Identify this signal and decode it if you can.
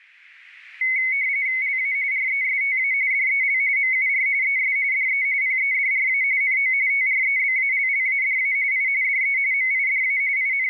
RTTY (45.45 baud, 170 Hz shift), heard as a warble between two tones, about 2150 Hz centre. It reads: LA RESTA DEL MUR ES DE PEDRA NO TREBALLADA I DE MIDA …